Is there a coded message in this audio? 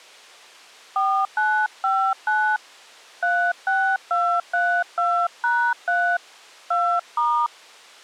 Yes: DTMF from 1.0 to 7.5 s, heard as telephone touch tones, dialled by hand, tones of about 290 ms. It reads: 4959 36232#3 2*